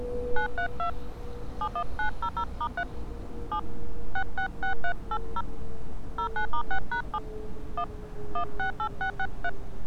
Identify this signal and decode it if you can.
DTMF, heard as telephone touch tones, dialled by hand, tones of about 80 ms, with street noise. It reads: 932 71900*3 7 666380 09*6#7 1 168663